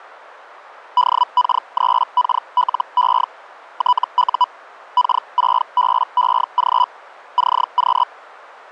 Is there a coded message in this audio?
Yes: Hellschreiber (Feld-Hell, 122.5 baud) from 1.0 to 8.0 s, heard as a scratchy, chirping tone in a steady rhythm, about 990 Hz. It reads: DK3KLE TU K6BEG CQ